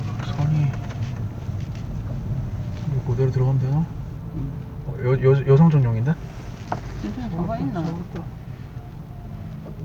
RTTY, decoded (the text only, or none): none